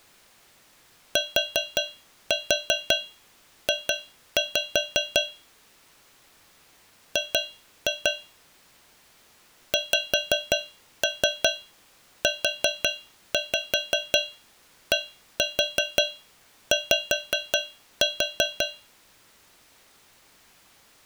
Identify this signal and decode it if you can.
Tap code, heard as taps on a metal pipe, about 5 knocks a second. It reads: TJ G XUDY